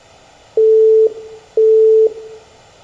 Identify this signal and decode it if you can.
Telephone call progress tone (single-tone plan, as in Europe, Japan and elsewhere), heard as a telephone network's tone, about 440 Hz, 0.5 s on and 0.5 s off, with room echo. Busy tone.